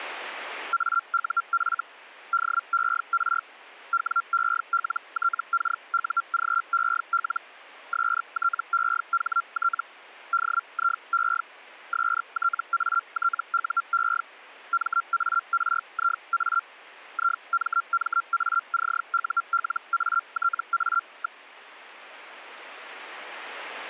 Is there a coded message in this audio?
Yes: Hellschreiber (Feld-Hell, 122.5 baud) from 0.7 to 21.4 s, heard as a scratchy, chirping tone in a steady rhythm, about 1370 Hz. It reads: AUF DER WELTKUGEL STEHT DIE STATUE MARIA IMMACULATA.